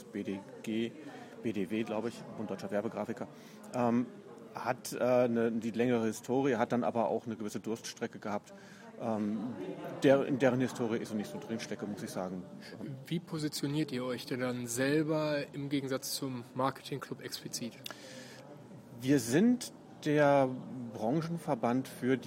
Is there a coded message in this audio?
No.